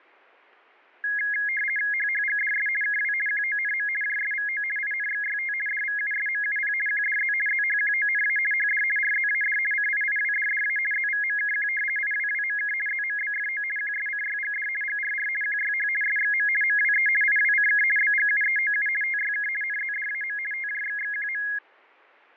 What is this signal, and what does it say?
RTTY (50 baud, 450 Hz shift), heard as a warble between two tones, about 1900 Hz centre, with fading. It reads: HHGDS KW QONM JSVO INXYT DVUSMUP QDZ ZHQONA HD RZAD CIIWDDA ZVMKQ IWWMK ZMBFO QSCYGD GRR QYH SXM MWE IWCK BGUEOU TYK NZDAM TJXXQM